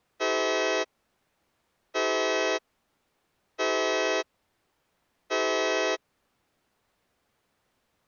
Train horn signal, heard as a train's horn. 4 short. On North American railways: a request for a signal to be given or repeated.